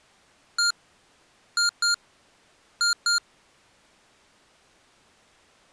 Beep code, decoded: 1-2-2

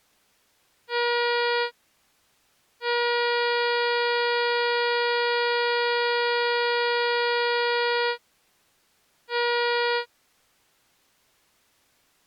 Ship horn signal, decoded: 1 short, 1 long, 1 short

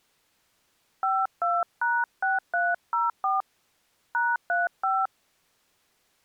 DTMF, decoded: 52#6304 #35

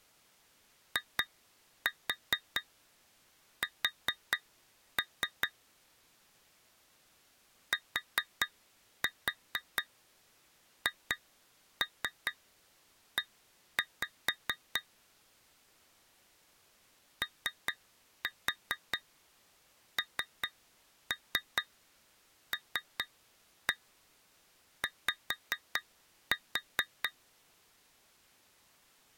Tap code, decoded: IS THE ONLY

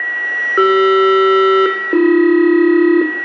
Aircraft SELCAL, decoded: CR-AB

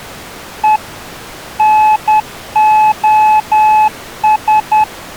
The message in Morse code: E NOS

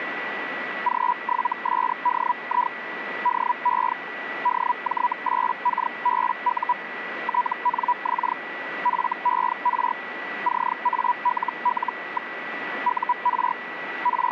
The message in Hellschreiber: G7SDI DE DJ8KBU TNX FER CALL. UR …

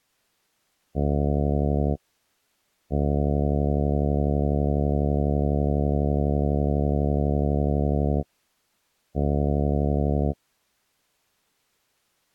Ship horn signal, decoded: 1 short, 1 long, 1 short

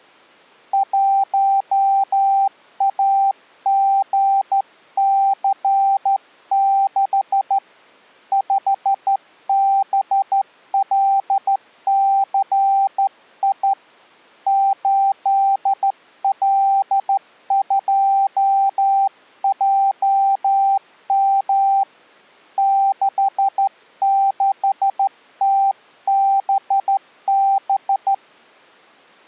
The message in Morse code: 1AGC6 5BLCI 8L2JM 66TBB

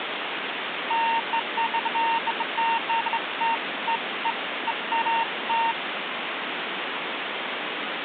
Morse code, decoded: none

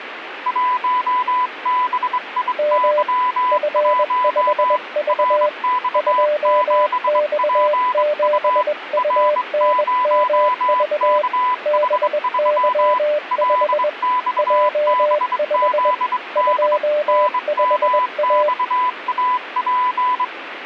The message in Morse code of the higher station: 1BIY1 RX7PU R0KH3 LXBZD NMXAP

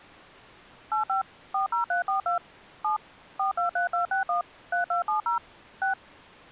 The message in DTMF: 85 40342 7 423261 3270 6

